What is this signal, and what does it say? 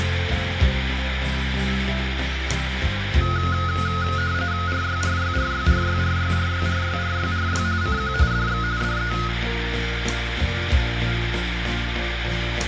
RTTY (45.45 baud, 170 Hz shift), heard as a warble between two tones, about 1360 Hz centre, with radio static and room echo. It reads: RYRYRYRYRYRYRYRYRY CQ DX DE